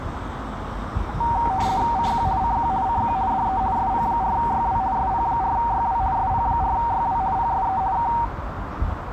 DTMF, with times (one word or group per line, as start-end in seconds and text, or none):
none